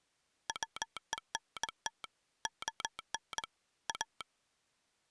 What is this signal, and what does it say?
Morse code, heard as a telegraph sounder, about 22 wpm. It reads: WENT ON A